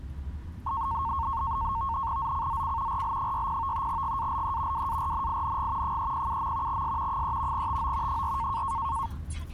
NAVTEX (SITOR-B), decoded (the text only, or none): ZCZC RL60 GALE WARNING 307. S 3 TO 4